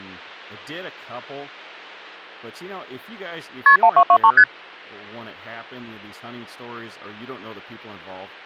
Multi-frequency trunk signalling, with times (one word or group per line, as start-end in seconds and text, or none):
3.7-3.8 KP
3.8-4.3 1223
4.4-4.4 ST